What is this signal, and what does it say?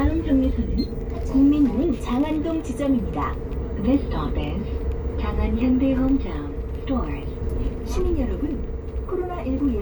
The noise inside a bus. There is no code.